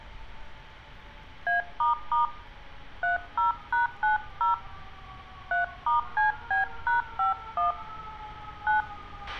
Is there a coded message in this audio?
Yes: DTMF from 1.5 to 8.8 s, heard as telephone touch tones, dialled by hand, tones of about 140 ms, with a squelch burst at the end and street noise. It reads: A** 30#90 3*CB#51 9